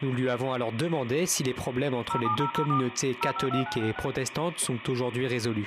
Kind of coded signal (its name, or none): DTMF